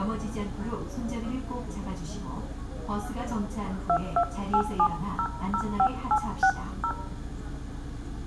DTMF, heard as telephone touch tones, dialled by hand, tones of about 70 ms, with room echo and the noise inside a bus. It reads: 2287005860